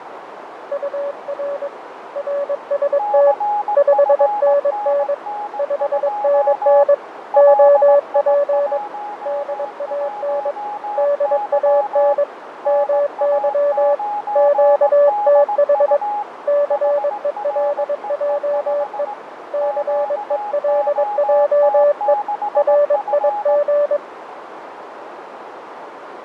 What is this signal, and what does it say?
Morse code, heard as two keyed tones, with radio static, fading and a narrow filter. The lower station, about 22 wpm, 580 Hz: UR RST 5NN 5NN OP DAN DAN MY QTH CELJE CELJE RIG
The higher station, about 18 wpm, 830 Hz: CFNN2 LI11Y NA9DU HREE5 QOT6F